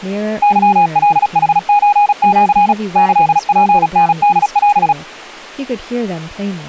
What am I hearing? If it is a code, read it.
Morse code (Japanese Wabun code), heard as a keyed tone, machine-sent, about 36 wpm, 820 Hz, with speech in English. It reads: ケカヌソシ キツタホオ